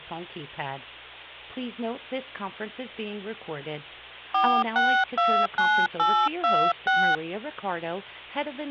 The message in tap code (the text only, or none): none